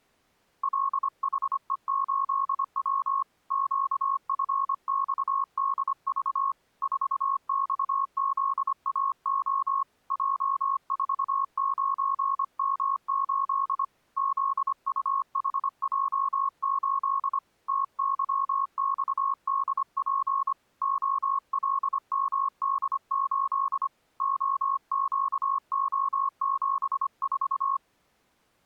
Morse code, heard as a keyed tone, hand-sent with a paddle, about 25 wpm, 1090 Hz. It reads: LHE8W QFXDV 4XZAO J49M8 ZUHJ8 TYXDP OLMD8 OQO74